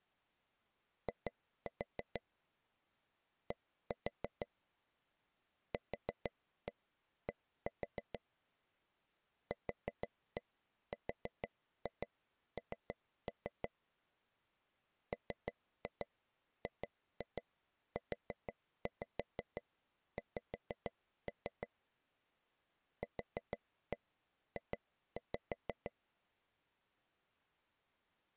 Tap code, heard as taps on a table, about 6 knocks a second. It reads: I D QD QRN MGUX QJ